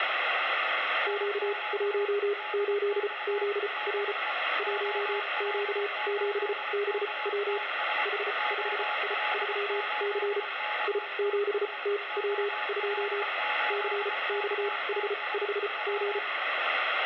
Morse code, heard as a keyed tone, machine-sent, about 34 wpm, spaced as for 25 wpm, 410 Hz, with radio static and a weaker station near 840 Hz. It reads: Q18ZR 1Q7BW H5I3C I7TW2 CXH5G